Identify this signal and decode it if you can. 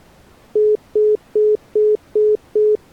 Telephone call progress tone (single-tone plan, as in most of Europe), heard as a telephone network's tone, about 420 Hz, 0.2 s on and 0.2 s off. Congestion tone.